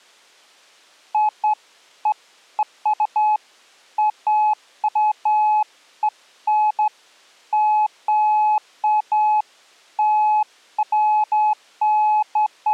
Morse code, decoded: none

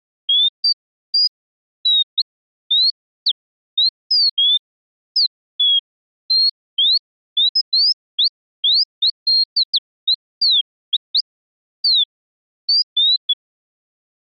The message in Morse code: none

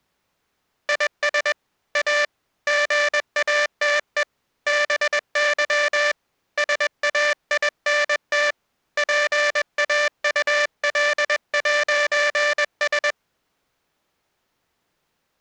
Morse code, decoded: IS A GATE BY SAINT PAUL'S

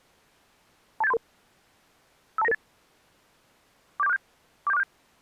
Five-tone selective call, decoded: 28733 52998 47467 47467

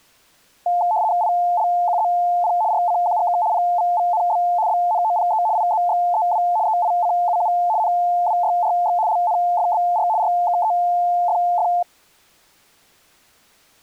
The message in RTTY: ILQZP RCQGK PVVNB BNOPE IZXEW EICUU NWYRX LNFBR RKEFF

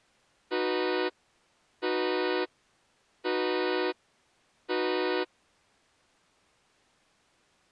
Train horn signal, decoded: 4 short

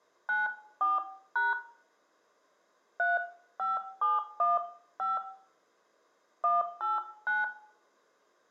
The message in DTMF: 94# 35715 189

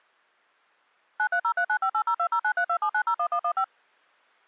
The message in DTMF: 93039580209327901115

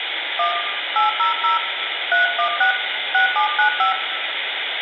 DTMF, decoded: 1 800 316 6795

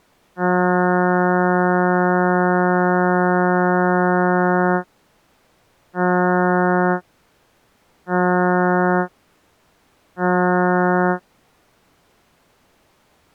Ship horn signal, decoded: 1 long, 3 short

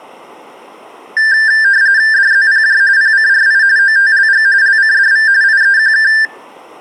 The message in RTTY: DZPJ PCRI OTLG LCDV IEQK

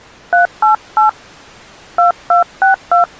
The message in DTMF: 388 2262

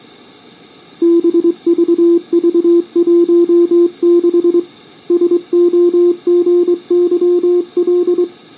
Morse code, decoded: BVV16 SOGYL

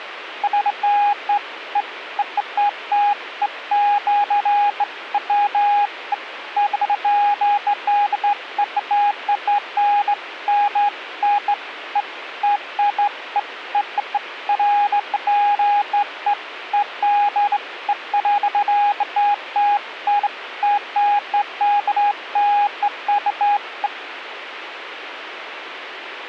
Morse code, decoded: none

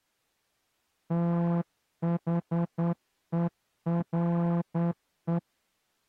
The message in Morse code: THERE

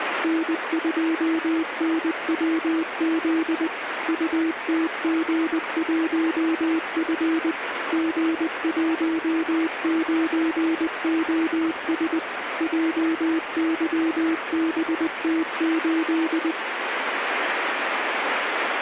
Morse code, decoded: N2NWZ UTG1F G19OS JYBT8

